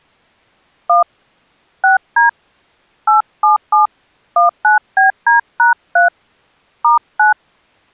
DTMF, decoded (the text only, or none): 1 6D 877 19BD#3 *9